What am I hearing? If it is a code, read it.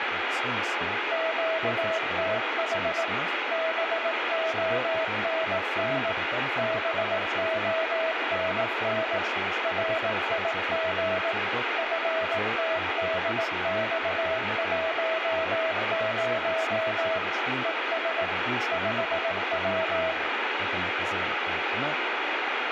Morse code, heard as a keyed tone, machine-sent, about 18 wpm, 650 Hz, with radio static, room echo and speech in Hebrew. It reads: QTH BONN BONN RIG FTDX10 ES 5W